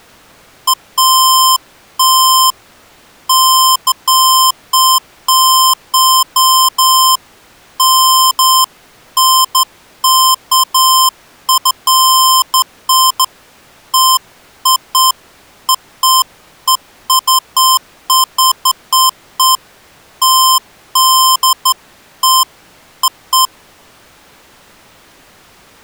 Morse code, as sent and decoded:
none

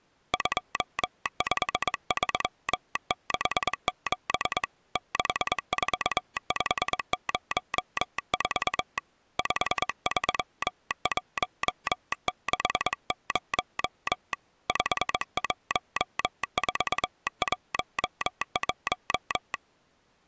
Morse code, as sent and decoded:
..--- ..... ...-- -.... --... / -.... ....- ..... ----- ....- / ..... ...-- .---- -.... ----- / ..... .---- ....- .---- .----
25367 64504 53160 51411

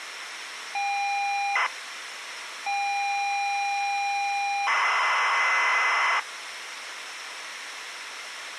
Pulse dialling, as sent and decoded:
none

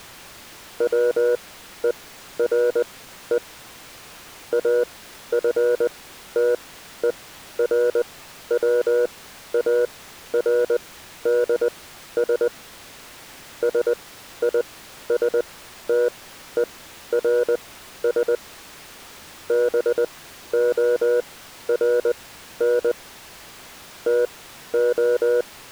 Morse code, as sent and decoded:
.-- . .-. . / .- ..-. - . .-. .-- .- .-. -.. ... / ... .. ... - . .-. ... / -... --- .-. -. / - ---
WERE AFTERWARDS SISTERS BORN TO

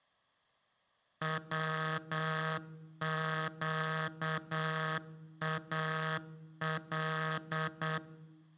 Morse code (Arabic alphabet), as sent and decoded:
.-- --.- .- .-..
وقال

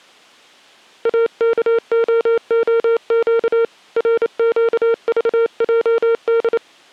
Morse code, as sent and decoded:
.- -.- --- --- --.- / .-. --.- ...- .--- -..
AKOOQ RQVJD

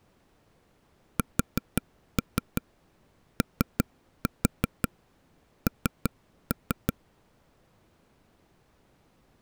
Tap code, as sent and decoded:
4-3 3-4 3-3
SON

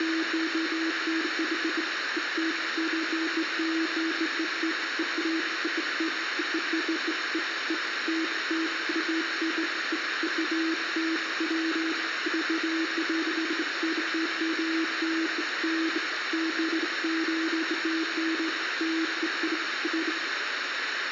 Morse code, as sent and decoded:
none

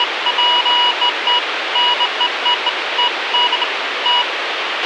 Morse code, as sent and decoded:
none

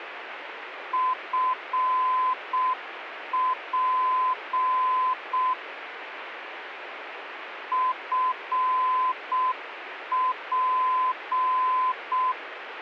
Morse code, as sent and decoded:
..-. .--. / ..-. .--.
FP FP

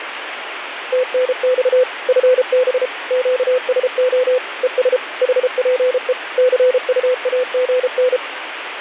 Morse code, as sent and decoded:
- -. -..- / ..-. -... / --.- ... --- / . ... / .... .--. . / -.-. ..- .- --. -.
TNX FB QSO ES HPE CUAGN

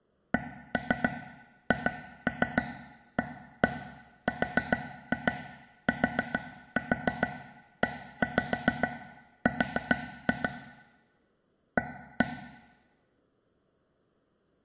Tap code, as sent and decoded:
1-3 2-3 1-1 4-2 4-4 1-5 4-2 / 1-1
CHARTER A

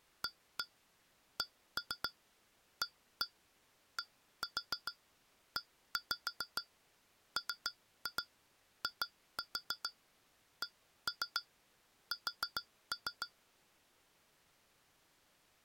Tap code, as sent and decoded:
1-1 1-3 1-1 1-4 1-5 3-2 2-4 1-3 4-3
ACADEMICS

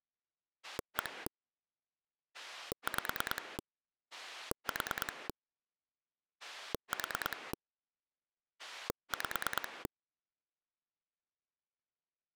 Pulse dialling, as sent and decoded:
1 / 5 / 4 / 4 / 5
1 5 4 4 5

